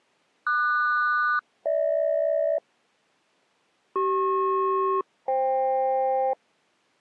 Aircraft SELCAL, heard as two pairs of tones. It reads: QS-GH CP-FK